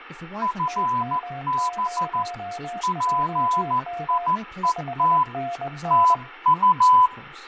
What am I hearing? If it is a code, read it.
Morse code, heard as two keyed tones, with fading and speech in English. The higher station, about 14 wpm, 1000 Hz: FB PIET TU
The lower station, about 21 wpm, 700 Hz: TM0JM 5NN